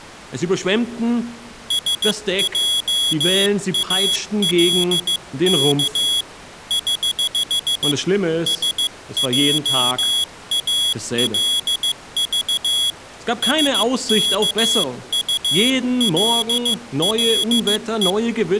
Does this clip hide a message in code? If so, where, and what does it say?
Yes: Morse code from 1.6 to 18.2 s, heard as a high beeper, hand-sent with a paddle, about 15 wpm, 3350 Hz. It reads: SJALK <HH> SJALV SKULLE